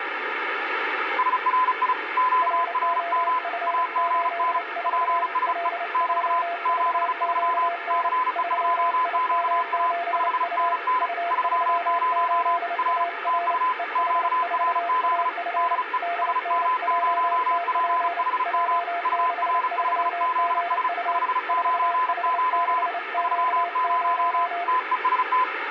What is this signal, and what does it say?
Morse code, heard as two keyed tones, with radio static. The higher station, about 35 wpm, 1010 Hz: SRI QRM AGN PSE <BT> 73 CE2QA 5NN 30 R TU QRZ DE SM0PHM UR5ZS 599 30 TEST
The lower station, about 29 wpm, 690 Hz: ROF84 LJVQN 3IM7U U38AR EH4AF DNJTP J63GU 4H6Q0